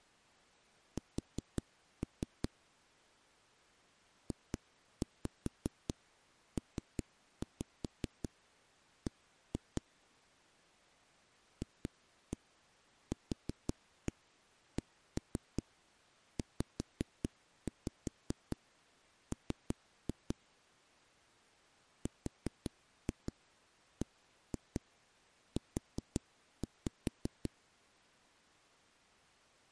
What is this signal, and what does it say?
Tap code, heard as knocks on a wall, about 5 knocks a second. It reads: S JPB FQCZM RBU